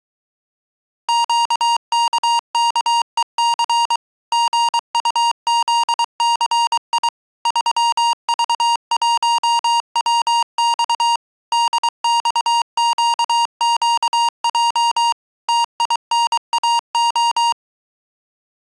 Morse code, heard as electronic beeps, machine-sent, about 23 wpm, 940 Hz. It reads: QKKEC GUZCI 3V1WX DXQQJ TINAO